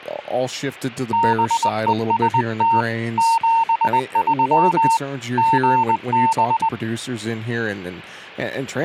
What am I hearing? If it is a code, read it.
Morse code, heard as a keyed tone, hand-sent with a paddle, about 20 wpm, 910 Hz, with speech in English. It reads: BEST 73 GB